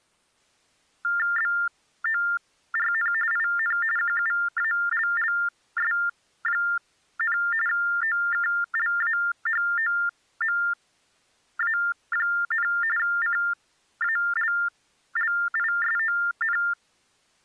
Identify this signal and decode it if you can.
TTY/TDD text telephone tones (45.45 baud Baudot), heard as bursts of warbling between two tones, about 400 Hz shift, 1600 Hz centre. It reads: BORN IN QUALLS, OKLAHOMA, CALLISON